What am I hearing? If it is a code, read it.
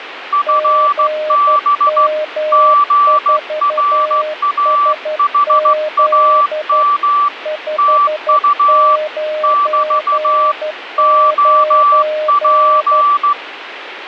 Morse code, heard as two keyed tones, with radio static. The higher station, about 15 wpm, 1160 Hz: FB GRAHAM TU <BT> OP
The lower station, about 12 wpm, 610 Hz: GM4SZ 599